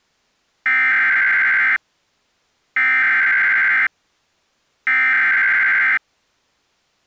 Emergency Alert System (SAME) tones (header bursts), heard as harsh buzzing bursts, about 520.83 baud.